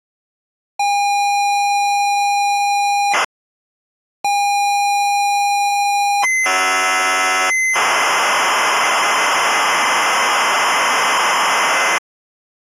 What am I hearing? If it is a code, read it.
ZX Spectrum tape loading, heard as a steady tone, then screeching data.